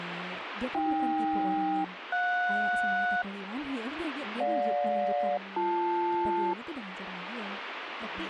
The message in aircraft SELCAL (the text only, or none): AK-JS GJ-BL